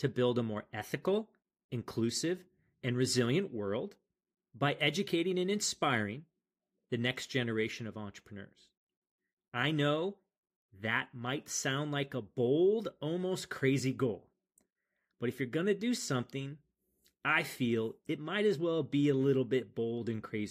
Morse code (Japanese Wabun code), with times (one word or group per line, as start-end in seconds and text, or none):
none